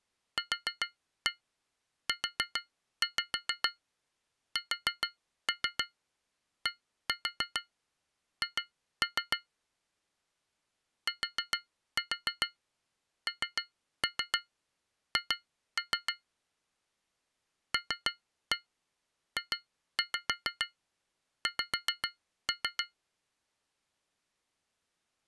Tap code, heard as taps on glass, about 6 knocks a second. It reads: QUSDH TNH LJX